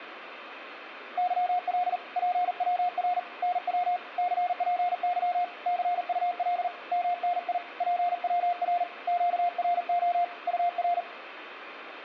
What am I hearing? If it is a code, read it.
Morse code, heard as a keyed tone, hand-sent with a paddle, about 40 wpm, 710 Hz, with room echo. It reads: YL PWR NW CPY CUL MNI PWR QRO UR